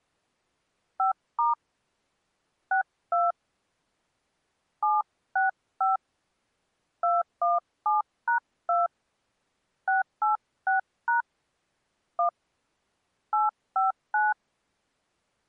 DTMF, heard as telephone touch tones, dialled by hand, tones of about 140 ms. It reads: 5* 62 765 217#2 686# 1 859